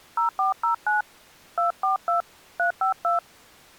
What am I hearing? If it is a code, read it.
DTMF, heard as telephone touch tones, dialled by hand, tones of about 120 ms. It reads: 0409 242 352